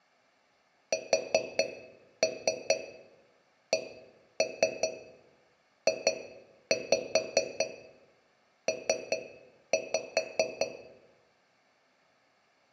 Tap code, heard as taps on a metal pipe, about 5 knocks a second, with room echo. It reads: SCJP